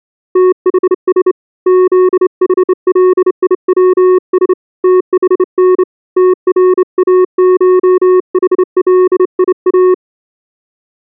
Morse code (Greek alphabet), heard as a keyed tone, hand-sent with a straight key, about 28 wpm, 370 Hz. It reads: ΤΗΣ ΖΗΛΙΩΣ ΤΗΝ ΤΡΑΧΗΛΙΑ